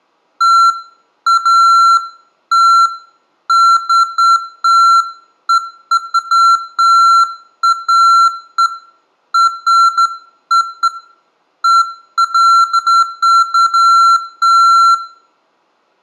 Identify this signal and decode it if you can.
Beeps of irregular length, with room echo. There is no code.